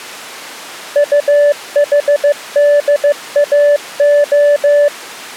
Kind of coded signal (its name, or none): Morse code